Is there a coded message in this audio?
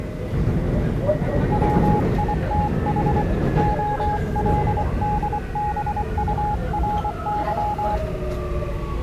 Yes: Morse code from 1.5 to 8.0 s, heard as a keyed tone, hand-sent with a paddle, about 24 wpm, 840 Hz, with the noise inside a subway train. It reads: WITH OLDBURY